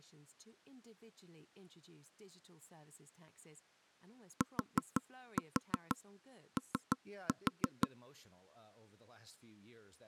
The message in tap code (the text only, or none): TO